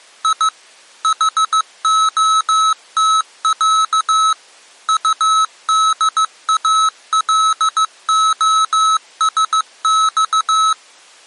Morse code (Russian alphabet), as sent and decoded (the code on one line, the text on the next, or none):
.. / .... --- - .-.- / ..- -.. .- .-.. --- ... -..-
И ХОТЯ УДАЛОСЬ